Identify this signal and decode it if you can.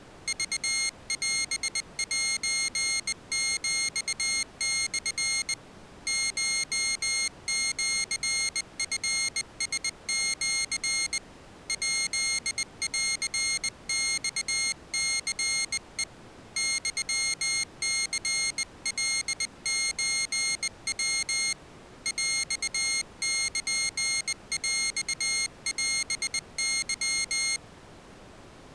Morse code (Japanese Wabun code), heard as a high beeper, hand-sent with a bug key, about 20 wpm, 2150 Hz. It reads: クオセヒモ コシチラシ ヱンマニヘ ユニカソヤ ヰルヰオケ